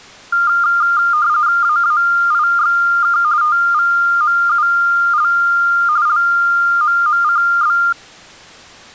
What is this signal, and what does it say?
RTTY (45.45 baud, 170 Hz shift), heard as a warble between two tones, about 1300 Hz centre. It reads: AAIXK TVMUL LMMCB